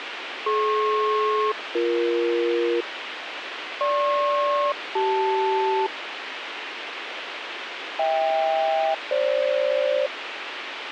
Aircraft SELCAL, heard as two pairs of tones, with radio hiss and a squelch burst at the end. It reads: DP-BE GP-CL HK-FG